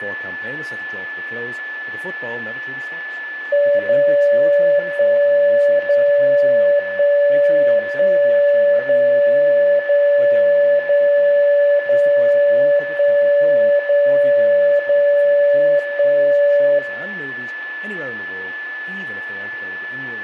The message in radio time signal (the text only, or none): 0 1 0 1 1 0 0 0 0 1 0 0 1